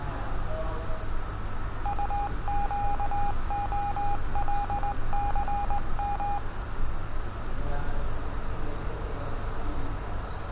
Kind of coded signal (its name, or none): Morse code